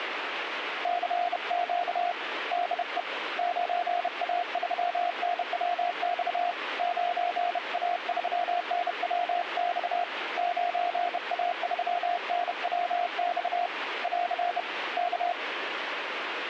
Morse code, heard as a keyed tone, hand-sent with a bug key, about 31 wpm, 700 Hz, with radio static. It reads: CQ DE 9A3NWX 9A3NWX 9A3NWX <AR> K